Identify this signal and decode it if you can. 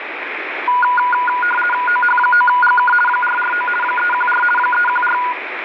RTTY (50 baud, 450 Hz shift), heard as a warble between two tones, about 1210 Hz centre, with radio static. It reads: OH9GK 449 314 314